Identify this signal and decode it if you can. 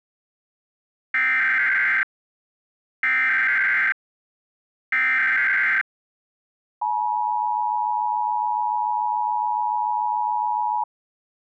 Emergency Alert System (SAME) tones (header bursts, then the 853 and 960 Hz attention tone), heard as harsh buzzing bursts, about 520.83 baud.